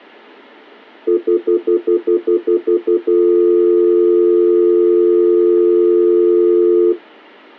Telephone call progress tone (North American plan), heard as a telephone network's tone, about 350, 440 Hz, 0.1 s on and 0.1 s off. Stutter dial tone.